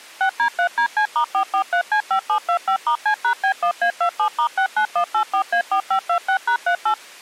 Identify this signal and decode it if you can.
DTMF, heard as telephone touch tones, dialled by machine, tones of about 90 ms. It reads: 6D3DC*443C5725*C#B1A27*69184A4526#38